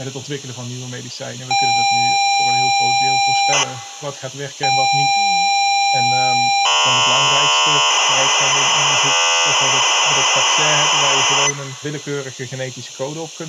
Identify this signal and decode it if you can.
ZX Spectrum tape loading, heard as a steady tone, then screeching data.